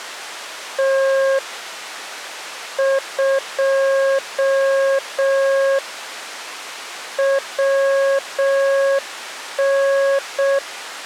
Morse code, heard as a keyed tone, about 6 wpm, 540 Hz. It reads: T 2 WN